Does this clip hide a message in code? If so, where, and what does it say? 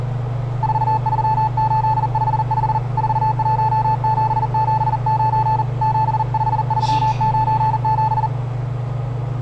Yes: Morse code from 0.6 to 8.3 s, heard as a keyed tone, hand-sent with a paddle, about 40 wpm, 870 Hz, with the noise inside a lift. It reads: 43855 41779 75397